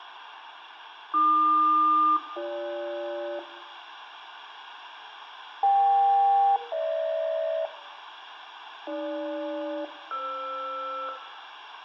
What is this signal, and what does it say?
Aircraft SELCAL, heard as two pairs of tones. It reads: AQ-BG EK-GH AG-FR